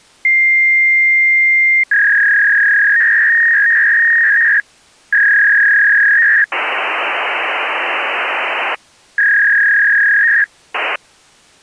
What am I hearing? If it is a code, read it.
Fax machine handshake, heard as a long tone, a warble and hiss.